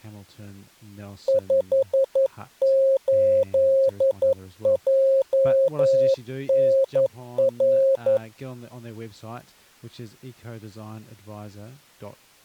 Morse code, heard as a keyed tone, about 11 wpm, 540 Hz, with speech in English. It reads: 58JNR